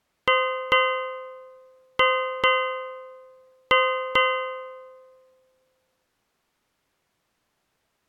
Ship's bell, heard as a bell. 6. Six half-hours of the watch have passed.